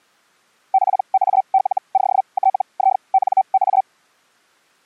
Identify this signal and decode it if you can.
Hellschreiber (Feld-Hell, 122.5 baud), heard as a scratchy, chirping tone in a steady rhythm, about 770 Hz. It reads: PALOTINA